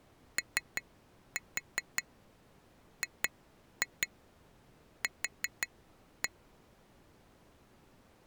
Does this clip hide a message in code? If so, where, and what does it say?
Yes: tap code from 0.4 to 6.3 s, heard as taps on glass, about 5 knocks a second. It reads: OGQ